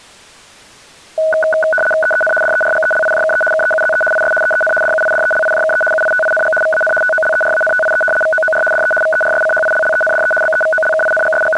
RTTY (75 baud, 850 Hz shift), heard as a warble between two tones, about 1060 Hz centre. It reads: EEN DERGELIJKE KEUZE IS EEN DUIDELIJKE UITING VAN TOLERANTIE VOOR DE VERSCHILLENDE …